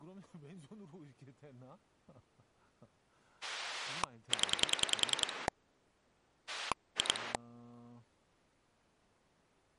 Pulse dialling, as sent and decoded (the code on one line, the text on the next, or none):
10 / 2
0 2